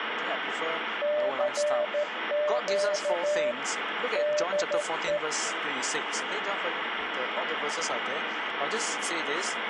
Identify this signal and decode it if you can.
Morse code, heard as a keyed tone, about 13 wpm, 600 Hz, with radio static. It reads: CQ DE